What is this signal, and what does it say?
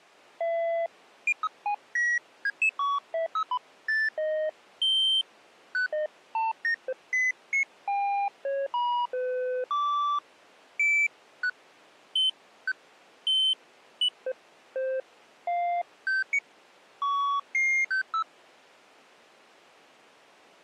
Electronic bleeps of random pitch and length. There is no code.